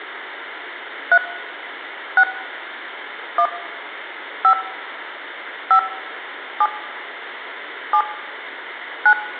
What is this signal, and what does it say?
DTMF, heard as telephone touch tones, dialled by hand, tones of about 70 ms, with hum and room echo. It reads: 3 6 1 5 5 7 7 9